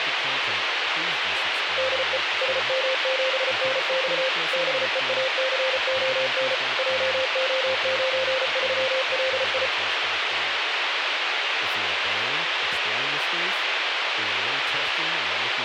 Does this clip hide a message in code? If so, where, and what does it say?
Yes: Morse code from 1.7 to 9.7 s, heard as a keyed tone, machine-sent, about 34 wpm, 520 Hz, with radio hiss, a squelch burst at the end and speech in English. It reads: DE SM7NX BEACON JO93LI